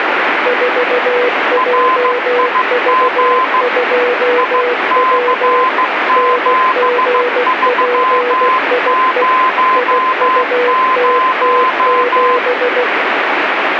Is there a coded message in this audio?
Yes: Morse code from 0.4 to 12.9 s, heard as two keyed tones, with radio static. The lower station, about 16 wpm, 490 Hz: 4JV2W NGPIE IUTT7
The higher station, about 15 wpm, 1030 Hz: RIG IC7300